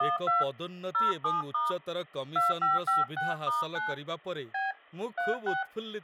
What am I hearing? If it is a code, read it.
DTMF, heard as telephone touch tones, dialled by hand, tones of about 170 ms, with speech in Odia. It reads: 12 07* 2556*9 B 36